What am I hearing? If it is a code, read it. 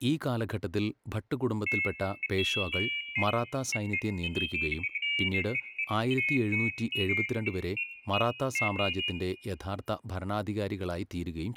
Pairs of high tones at irregular times, with room echo and speech in Malayalam. There is no code.